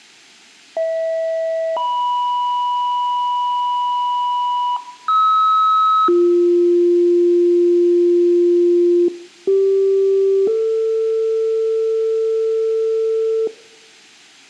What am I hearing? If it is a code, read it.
Two-tone page, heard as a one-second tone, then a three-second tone, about 650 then 980 Hz, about 1290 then 350 Hz, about 390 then 450 Hz.